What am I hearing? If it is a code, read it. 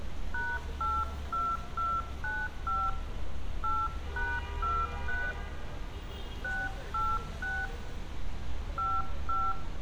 DTMF, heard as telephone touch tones, dialled by hand, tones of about 230 ms, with room echo and street noise. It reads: #82295 8#23 686 55